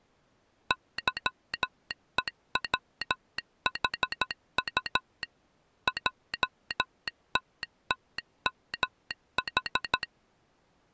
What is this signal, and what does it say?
Morse code, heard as a telegraph sounder, machine-sent, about 13 wpm. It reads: YEWHU JTTMH